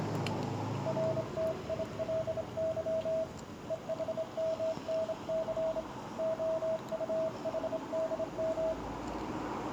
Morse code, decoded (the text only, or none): RTILY EHMNC OUHDM